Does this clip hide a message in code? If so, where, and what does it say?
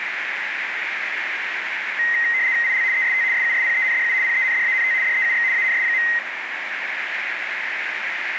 Yes: RTTY (75 baud, 170 Hz shift) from 2.0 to 6.2 s, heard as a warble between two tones, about 1950 Hz centre, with radio static, a narrow filter and the noise of a subway station. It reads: IL EST SUSPENDU PENDANT DEUX ANS.